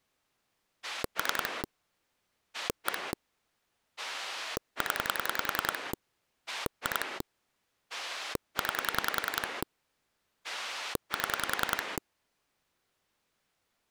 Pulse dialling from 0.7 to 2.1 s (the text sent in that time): 3